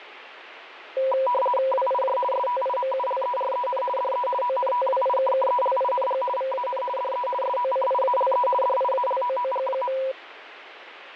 RTTY (50 baud, 450 Hz shift), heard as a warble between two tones, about 750 Hz centre, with radio static. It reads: WIJ STIMULEREN DE ONTWIKKELING VAN DE SOCIALE DIALOOG.